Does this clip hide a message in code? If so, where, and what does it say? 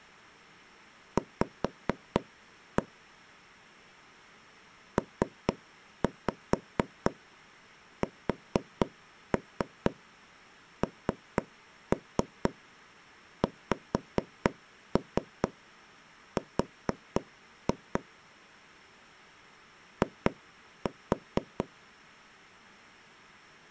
Yes: tap code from 1.2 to 21.6 s, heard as taps on a table, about 4 knocks a second. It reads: V PSNXR I